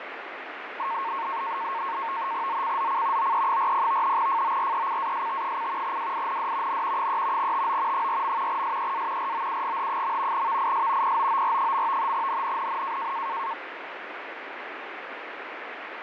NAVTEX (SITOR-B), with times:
2.5-3.3 ZCZC
3.2-4.2 OE40
4.2-6.0 FORECAST:
5.8-6.8 WIND
6.7-7.1 N
7.0-7.5 3
7.4-8.1 TO
7.9-8.6 4.
8.5-9.3 SEA
9.2-10.5 ROUGH.
10.3-11.2 VIS
11.0-12.1 POOR.
12.1-13.1 NNNN

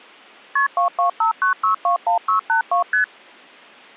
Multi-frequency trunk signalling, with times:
0.6-0.7 KP
0.8-2.8 2259621682
2.9-3.0 ST

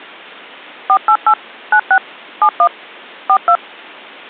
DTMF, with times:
0.9-1.3 488
1.7-2.0 96
2.4-2.7 71
3.3-3.6 42

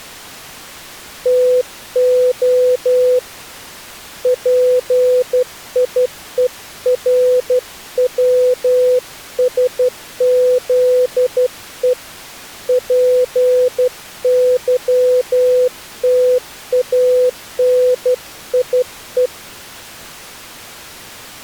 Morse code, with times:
1.3-3.2 TO
4.3-11.9 PIERWSZE
12.7-19.3 PYTANIE

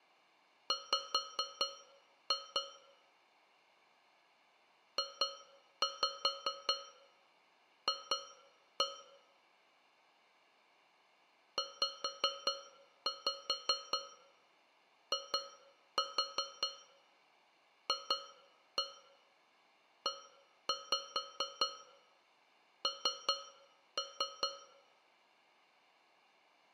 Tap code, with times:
0.7-2.6 W
5.0-8.8 JF
11.6-24.5 ZIFEN

